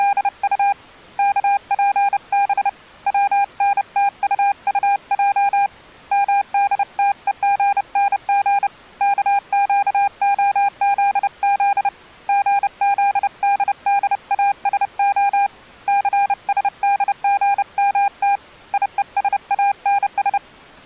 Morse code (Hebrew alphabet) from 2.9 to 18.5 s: צנתטטע מדתוגנג כקהזז גזדדאשה סשדגמת

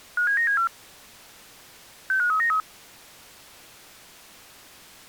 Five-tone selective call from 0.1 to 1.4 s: 57974

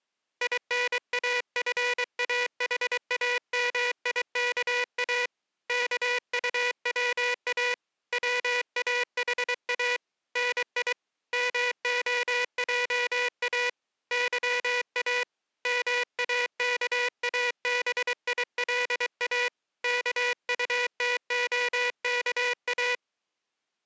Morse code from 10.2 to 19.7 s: NI MOJA YA MAKABILA

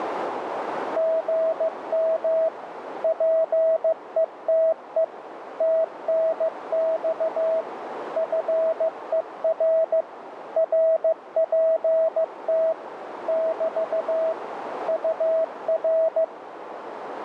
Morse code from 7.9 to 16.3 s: FER RPT <BT> UR

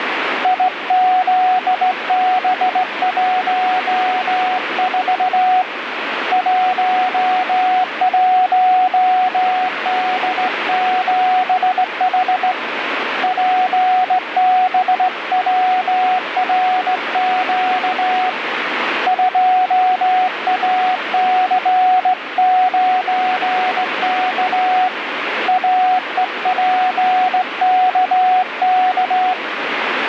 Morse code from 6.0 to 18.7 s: 11D7H PBWRQ

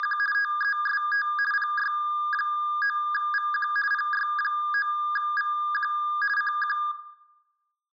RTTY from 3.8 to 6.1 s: PY9VQ

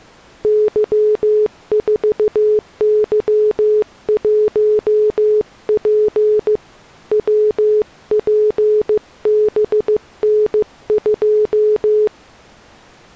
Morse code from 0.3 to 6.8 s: Y4Y1P

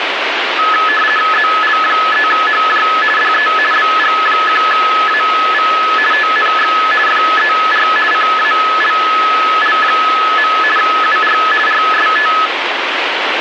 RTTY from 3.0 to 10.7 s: DE BG1AV TNX FER CALL.

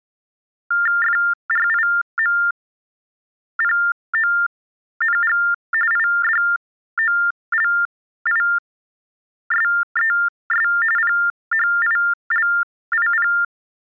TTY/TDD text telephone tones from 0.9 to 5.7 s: FRIMPONG

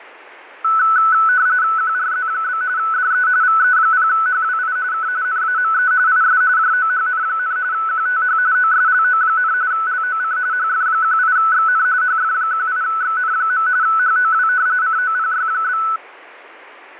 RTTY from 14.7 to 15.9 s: COPY?

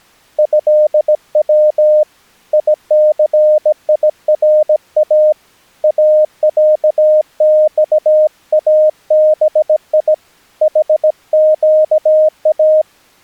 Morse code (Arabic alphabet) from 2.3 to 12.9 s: يثيرا اعصابي حقا

